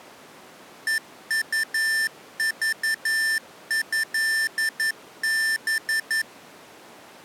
Morse code (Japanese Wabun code), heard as electronic beeps, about 11 wpm, 1800 Hz. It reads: ヘウクトハ